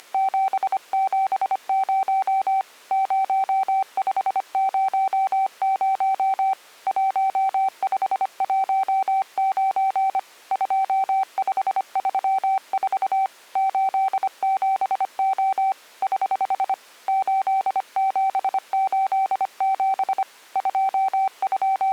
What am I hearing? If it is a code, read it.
Morse code, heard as a keyed tone, hand-sent with a paddle, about 25 wpm, 770 Hz. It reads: … 0500 1519 2534 87O <HH> 8787 …